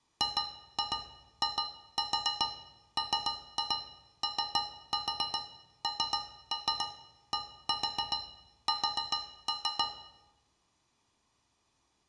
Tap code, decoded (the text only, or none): GIMONDS